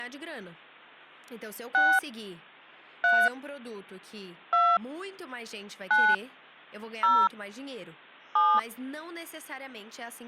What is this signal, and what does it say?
DTMF, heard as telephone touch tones, dialled by hand, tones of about 240 ms, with speech in Portuguese. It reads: 6 3 2 9 0 7